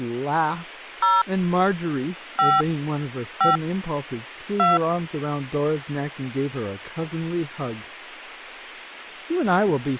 DTMF, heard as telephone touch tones, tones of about 170 ms, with speech in English. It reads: 0 5 5 2